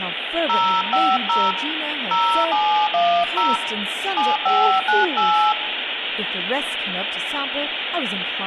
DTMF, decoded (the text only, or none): 050 0710 7598